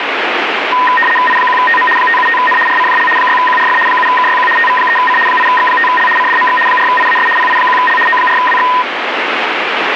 RTTY (75 baud, 850 Hz shift), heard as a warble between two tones, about 1430 Hz centre, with radio static. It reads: I1TM 575N RCJL 6QRF 7KYQ TV3C 8X5L CDMX 4IAS PI1L O4WX